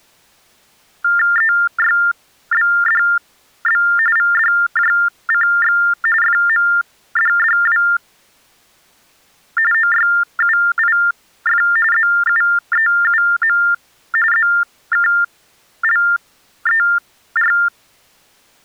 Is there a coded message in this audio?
Yes: TTY/TDD text telephone tones (45.45 baud Baudot) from 1.0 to 17.7 s, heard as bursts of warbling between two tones, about 400 Hz shift, 1600 Hz centre. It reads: EYBDB VDJCX FMDDW OYUIF ZUEUM ZKLER